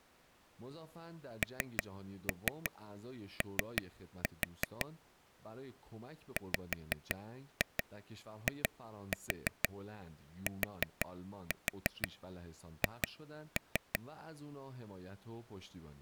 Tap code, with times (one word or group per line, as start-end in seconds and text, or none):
1.4-4.9 NO
6.4-14.0 WITH